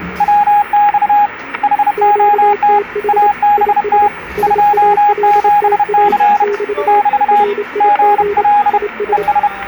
Morse code, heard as two keyed tones, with static crashes and the noise of a cafe. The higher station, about 31 wpm, 830 Hz: WX HOT ABT 27C <BT> GL ES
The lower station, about 27 wpm, 410 Hz: QTH IS SALTA <BT> RIG IS